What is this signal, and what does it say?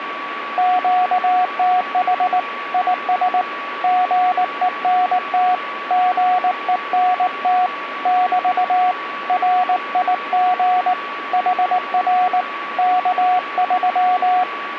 Morse code, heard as a keyed tone, hand-sent with a paddle, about 19 wpm, 730 Hz, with radio static and a steady whistle near 1140 Hz. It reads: QTH IS GENT GENT <BT> RIG HR K3